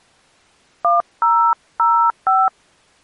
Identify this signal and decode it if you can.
DTMF, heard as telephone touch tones, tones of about 250 ms. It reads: 1005